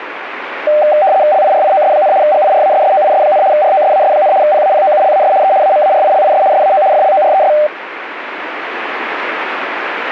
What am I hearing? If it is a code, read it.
RTTY (75 baud, 170 Hz shift), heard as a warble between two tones, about 690 Hz centre, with radio static. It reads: LIRIOS, GIRASSOIS, ROSAS, PAPOULAS E AMARILIS SAO FLORES